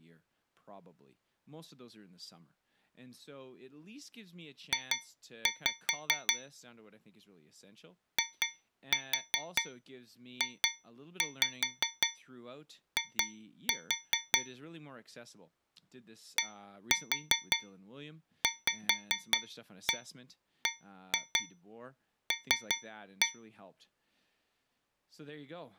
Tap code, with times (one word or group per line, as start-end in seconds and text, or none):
4.7-6.3 J
8.2-14.4 IJI
16.4-23.3 DVBL